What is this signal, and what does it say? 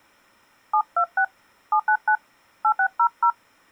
DTMF, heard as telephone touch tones, dialled by hand, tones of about 80 ms. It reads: 726 799 8600